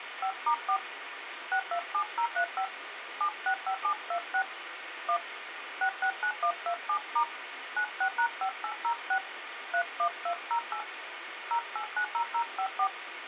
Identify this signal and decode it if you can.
DTMF, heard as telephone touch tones, dialled by hand, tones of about 80 ms, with radio hiss. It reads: 5*4 627035 765726 1 669127* 96#5806 31208 0890054